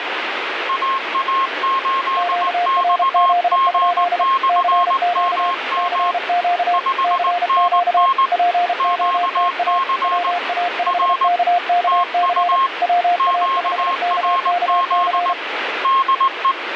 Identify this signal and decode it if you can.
Morse code, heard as two keyed tones, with radio static. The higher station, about 19 wpm, 1070 Hz: AA8XG/MM 5NN QC R TU QRZ DE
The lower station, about 32 wpm, 700 Hz: QRZ? CQ CQ CQ POTA WA5KKC WA5KKC